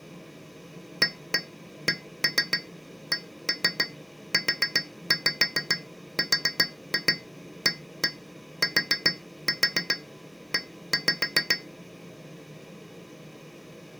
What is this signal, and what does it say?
Tap code, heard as taps on glass, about 7 knocks a second. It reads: ACCURATE